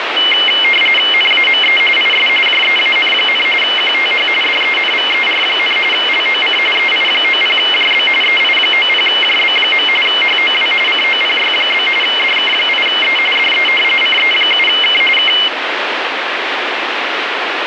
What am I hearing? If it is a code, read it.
RTTY (45.45 baud, 850 Hz shift), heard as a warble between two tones, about 2550 Hz centre, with radio static. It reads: NAME IS JEAN, QTH DENVER, LOC EI90JB EI90JB. HOW COPY? DK8E DE CE7K K